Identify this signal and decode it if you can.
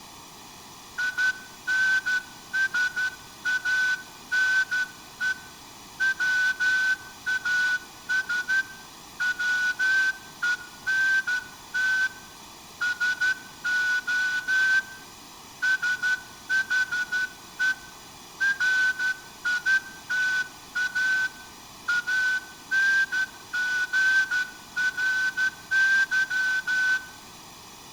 Morse code, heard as a whistle, hand-sent with a straight key, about 12 wpm, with room echo. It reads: INSANE WAS WENT SO SHE RITA ANGRY